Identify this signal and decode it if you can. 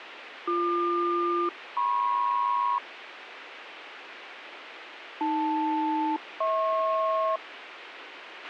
Aircraft SELCAL, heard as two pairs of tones, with radio hiss and a squelch burst at the end. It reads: BQ-MP AL-HP